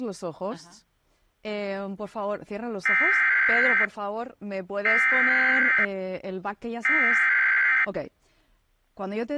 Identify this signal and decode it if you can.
Emergency Alert System (SAME) tones (header bursts), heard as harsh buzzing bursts, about 520.83 baud, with speech in Spanish.